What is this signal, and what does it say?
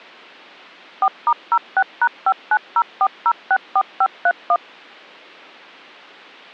DTMF, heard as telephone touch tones, dialled by machine, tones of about 60 ms. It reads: 4*06#5904064531